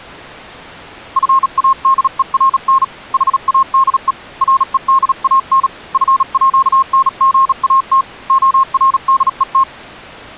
Morse code (with Swedish letters), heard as a keyed tone, hand-sent with a bug key, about 37 wpm, 1070 Hz. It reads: FADERN HADE REDAN FÅNGAT ORDET